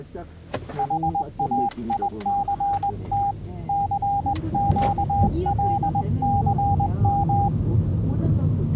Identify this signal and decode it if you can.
Morse code, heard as a keyed tone, hand-sent with a straight key, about 20 wpm, 800 Hz, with the noise inside a car. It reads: HAICT CQLCM